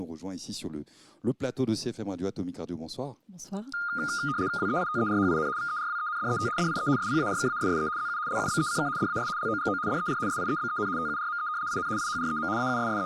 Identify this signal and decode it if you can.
RTTY (75 baud, 170 Hz shift), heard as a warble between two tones, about 1320 Hz centre. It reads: WEITERHIN VERWENDET DIE SPARKASSE ZU LUBECK DAS LOGO DER SIEBEN TURME IN IHREM …